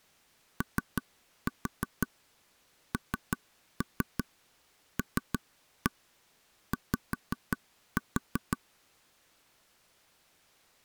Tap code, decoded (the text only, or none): ONLY